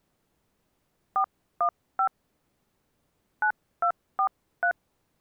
DTMF, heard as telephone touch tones, dialled by hand, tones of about 80 ms. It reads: 415 9243